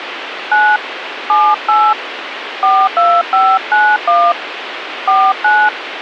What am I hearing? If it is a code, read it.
DTMF, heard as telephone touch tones, dialled by hand, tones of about 250 ms, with radio hiss. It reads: 9 78 42591 49